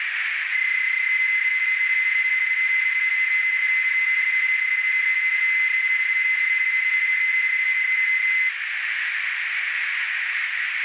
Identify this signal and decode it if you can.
PSK31 (31.25 baud), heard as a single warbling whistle, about 2050 Hz, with radio static and a narrow filter.